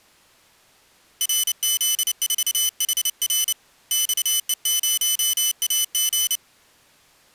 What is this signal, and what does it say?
Morse code, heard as a high beeper, hand-sent with a paddle, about 29 wpm, 3000 Hz. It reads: RZ4HR XE0AG